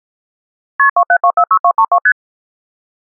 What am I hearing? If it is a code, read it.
Multi-frequency trunk signalling (R1, as on North American trunks), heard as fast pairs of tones, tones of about 70 ms. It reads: KP 27246232 ST